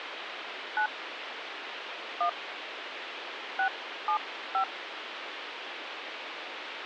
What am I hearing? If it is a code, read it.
DTMF, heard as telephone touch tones, dialled by hand, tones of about 90 ms, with phone line noise. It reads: 9 1 675